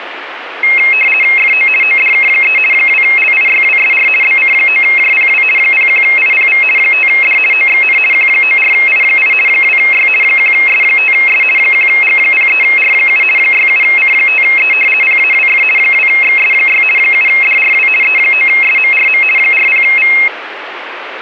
RTTY (50 baud, 450 Hz shift), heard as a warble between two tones, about 2350 Hz centre, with radio static. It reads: FO ODK3 2LIYWSR BC9JPW 01IPV 5D OXN Q94I8 2Y 1S5S 1G03R7 67C5E PAWF 2XS6 7DRW E9SMRM 40V